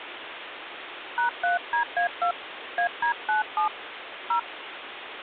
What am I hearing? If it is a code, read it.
DTMF, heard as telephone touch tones, dialled by hand, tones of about 120 ms, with phone line noise. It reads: #3DA2 AD97 0